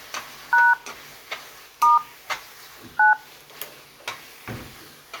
DTMF, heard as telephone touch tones, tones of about 170 ms, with kitchen noise. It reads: # * 9